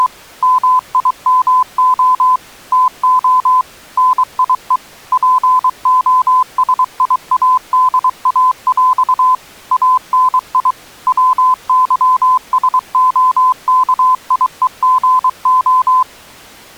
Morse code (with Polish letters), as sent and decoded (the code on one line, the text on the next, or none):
… / -- .. -- --- / - --- / -. .. . / .--. --- ... .. .- -.. .- .-..- / .- -. .. / .-- -.-- ... --- -.- .. . --. ---
… MIMO TO NIE POSIADAŁ ANI WYSOKIEGO